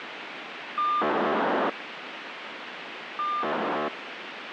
POCSAG pager data (2400 baud), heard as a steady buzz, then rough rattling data, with radio hiss.